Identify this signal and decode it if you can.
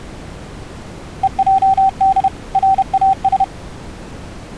Morse code (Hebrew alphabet), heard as a keyed tone, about 31 wpm, 770 Hz. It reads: ועד ראש